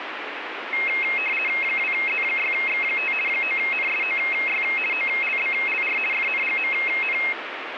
RTTY (50 baud, 450 Hz shift), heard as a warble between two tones, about 2350 Hz centre, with radio static. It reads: 2Z6X5 9NSOY OLBLR FNGMN